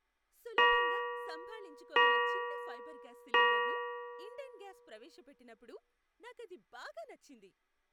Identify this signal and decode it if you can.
Clock strike, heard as a bell, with speech in Telugu. 3. Three o'clock.